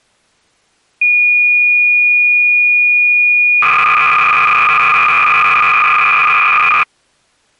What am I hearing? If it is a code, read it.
Cassette data (Kansas City type), 300 baud, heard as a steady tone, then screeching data.